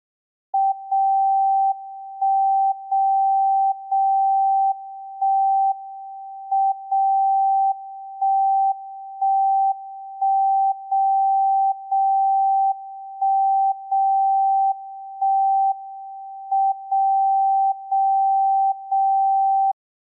Radio time signal (WWVB), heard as a tone whose level steps once a second, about 780 Hz. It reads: 0 1 0 0 1 M 0 1 1 1 0 0 1 0 1 M 0 0 0